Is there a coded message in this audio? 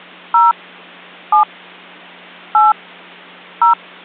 Yes: DTMF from 0.3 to 3.7 s, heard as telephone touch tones, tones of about 140 ms. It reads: 0 7 8 0